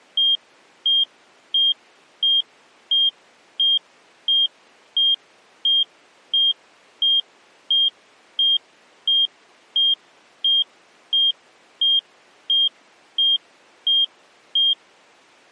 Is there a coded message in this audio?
No, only evenly repeated beeps.